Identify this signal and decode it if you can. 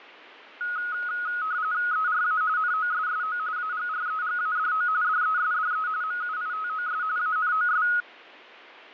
RTTY (45.45 baud, 170 Hz shift), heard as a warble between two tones, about 1360 Hz centre, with radio static. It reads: ERA NOSSO AGREGADO DESDE MUITOS ANOS